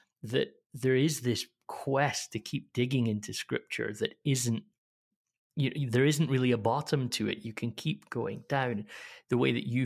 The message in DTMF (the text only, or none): none